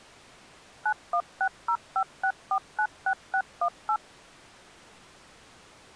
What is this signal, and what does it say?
DTMF, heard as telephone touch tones, dialled by machine, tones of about 70 ms. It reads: 916056496618